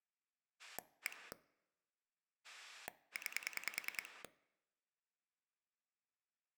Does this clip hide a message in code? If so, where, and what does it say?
Yes: pulse dialling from 0.6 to 4.3 s, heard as a rotary dial, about 10 pulses a second. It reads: 1 9